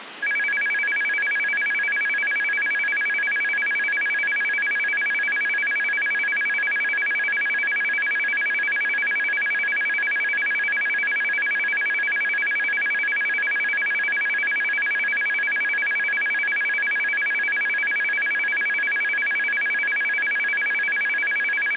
A tone that alternates evenly between two pitches, with phone line noise. There is no code.